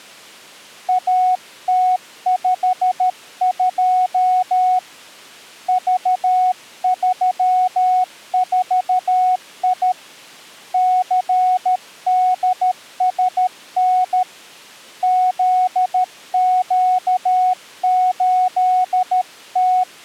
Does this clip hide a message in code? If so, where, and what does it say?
Yes: Morse code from 0.8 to 19.9 s, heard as a keyed tone, hand-sent with a paddle, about 13 wpm, 740 Hz. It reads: AT52 V34I CDSN ZQ8T